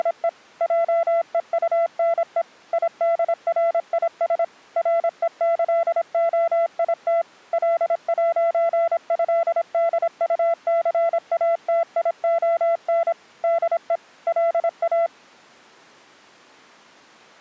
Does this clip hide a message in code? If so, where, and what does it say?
Yes: Morse code (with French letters) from 0.0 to 15.1 s, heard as a keyed tone, machine-sent, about 26 wpm, 670 Hz. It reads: … JEUNE IDRIS REÇOIT L'ÉDUCATION DE LA